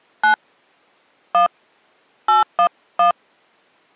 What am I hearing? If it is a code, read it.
DTMF, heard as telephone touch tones, dialled by hand, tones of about 110 ms. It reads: 9 1 811